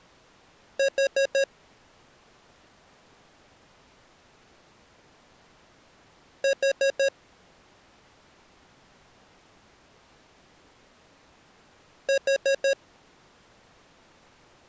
Alarm pattern, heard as an alarm's beeps, played three times, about 550 Hz. Temporal four. Carbon monoxide.